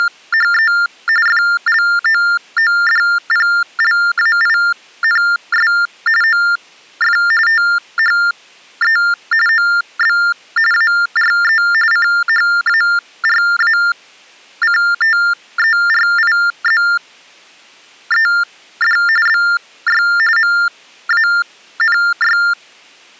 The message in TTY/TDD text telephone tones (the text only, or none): … FLOODPLAINS OF THE OB ARE CHARACTERIZED BY MANY